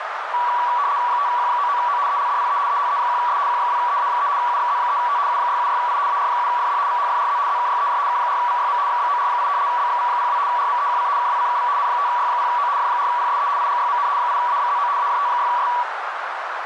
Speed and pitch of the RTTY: 75 baud, 170 Hz shift, 1060 Hz centre

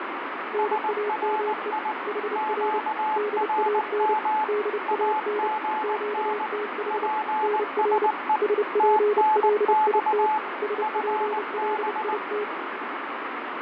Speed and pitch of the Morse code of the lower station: 30 wpm, 420 Hz

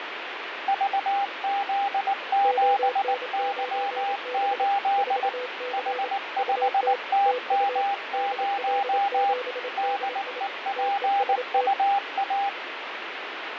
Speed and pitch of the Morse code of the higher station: 19 wpm, 800 Hz

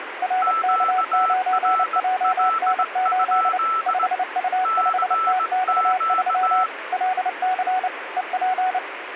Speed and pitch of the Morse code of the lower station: 29 wpm, 740 Hz

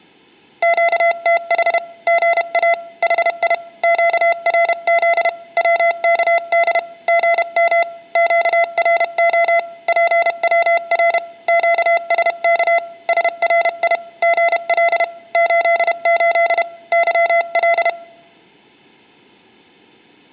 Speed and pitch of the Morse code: 31 wpm, 680 Hz

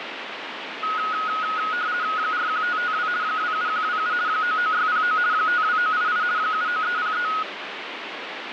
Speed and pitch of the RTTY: 50 baud, 170 Hz shift, 1360 Hz centre

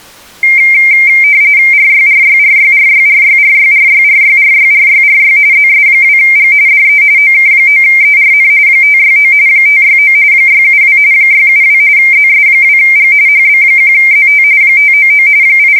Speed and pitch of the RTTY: 45.45 baud, 170 Hz shift, 2200 Hz centre

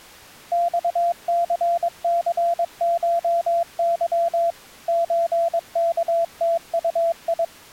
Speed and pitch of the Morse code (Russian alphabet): 22 wpm, 680 Hz

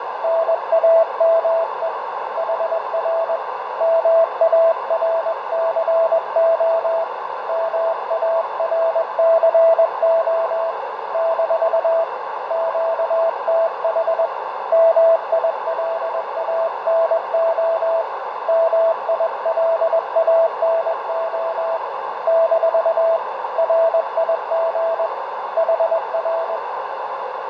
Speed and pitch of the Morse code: 21 wpm, 660 Hz

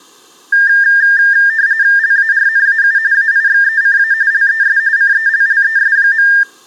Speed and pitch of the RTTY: 45.45 baud, 170 Hz shift, 1700 Hz centre

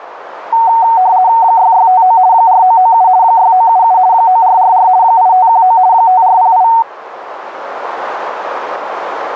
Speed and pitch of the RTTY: 50 baud, 170 Hz shift, 830 Hz centre

